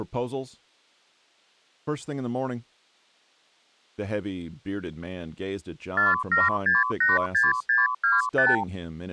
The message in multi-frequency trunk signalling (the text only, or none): 47686625